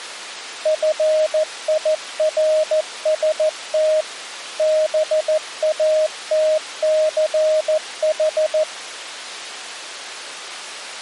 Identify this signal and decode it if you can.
Morse code, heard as a keyed tone, machine-sent, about 14 wpm, 620 Hz. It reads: FIRST BATCH